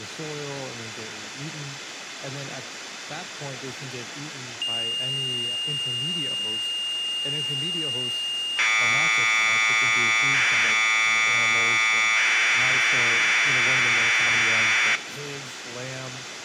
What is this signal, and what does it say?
Commodore tape loading (standard loader), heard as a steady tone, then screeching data, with speech in English.